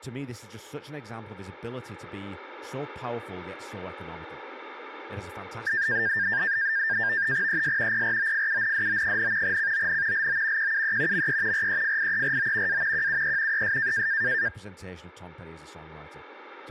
NAVTEX (SITOR-B), 100 baud, 170 Hz shift, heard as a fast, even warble, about 1700 Hz centre, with speech in English. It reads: ES PROFUNDO, CON LO QUE ME REFIERO A QUE ES